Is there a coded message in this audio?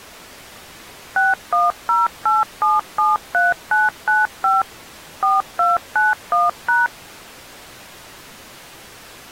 Yes: DTMF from 1.2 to 6.9 s, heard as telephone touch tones, dialled by machine, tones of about 180 ms. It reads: 6108773995 4291#